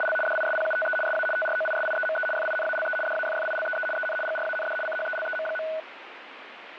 RTTY (75 baud, 850 Hz shift), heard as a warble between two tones, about 1060 Hz centre, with radio static. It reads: … DISPUTE SA TROISIEME FINALE DAFFILEE EN GRAND CHELEM.